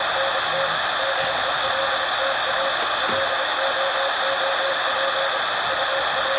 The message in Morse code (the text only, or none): … DELTA LOOP …